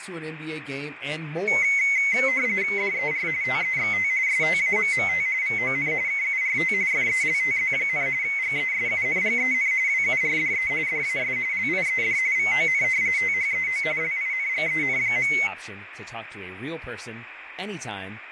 RTTY (45.45 baud, 170 Hz shift), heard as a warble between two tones, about 2150 Hz centre, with radio static and speech in English. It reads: DER TEXT STAMMT VON KURT FELTZ, GESUNGEN WURDE DAS LIED VON THEO LINGEN.